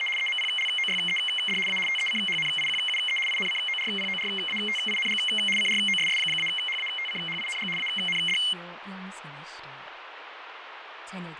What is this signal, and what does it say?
RTTY (75 baud, 850 Hz shift), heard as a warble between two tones, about 2550 Hz centre, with radio static, fading and speech in Korean. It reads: … EMPLOYED A TECHNIQUE INCORPORATING CROSS-HATCHING AND